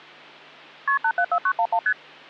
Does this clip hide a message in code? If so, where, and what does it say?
Yes: multi-frequency trunk signalling (R1, as on North American trunks) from 0.9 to 1.9 s, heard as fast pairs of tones, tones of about 70 ms, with hum. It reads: KP 874911 ST